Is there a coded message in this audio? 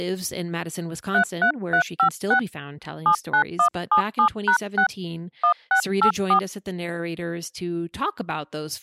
Yes: DTMF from 1.1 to 6.4 s, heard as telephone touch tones, dialled by hand, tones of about 90 ms, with speech in English. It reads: 33356 79177#6 1684